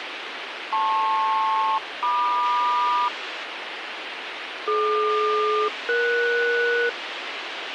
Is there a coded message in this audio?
Yes: aircraft SELCAL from 0.7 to 6.9 s, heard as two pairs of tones, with radio hiss. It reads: LP-MQ DQ-ES